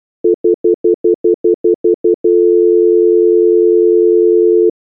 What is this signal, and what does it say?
Telephone call progress tone (North American plan), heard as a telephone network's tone, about 350, 440 Hz, 0.1 s on and 0.1 s off. Stutter dial tone.